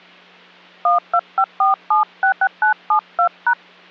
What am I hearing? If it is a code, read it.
DTMF, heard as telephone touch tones, dialled by hand, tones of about 100 ms. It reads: 1254766972#